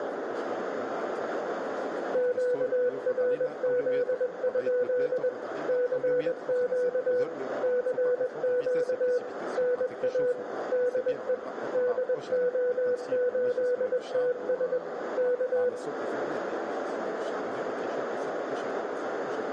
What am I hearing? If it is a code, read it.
Morse code, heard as a keyed tone, machine-sent, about 21 wpm, 500 Hz, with radio static, a narrow filter and room echo. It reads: QRZ? CQ CQ NA DE DO8TS K